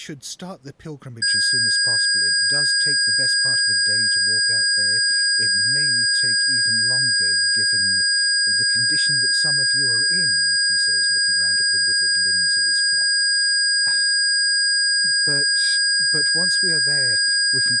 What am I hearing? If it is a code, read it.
A steady tone, with speech in English. There is no code.